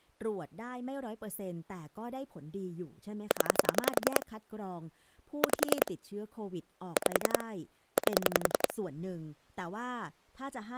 Pulse dialling, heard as clicks on a phone line, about 10 pulses a second, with speech in Thai. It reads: 0 5 5 8